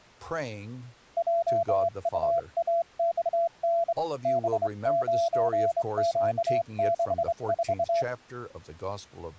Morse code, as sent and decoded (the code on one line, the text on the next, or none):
.--- ..- .- -..- -. / -... ----. --.- -.... ....-
JUAXN B9Q64